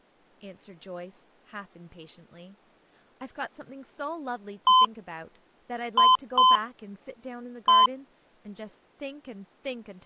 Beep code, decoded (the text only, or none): 1-2-1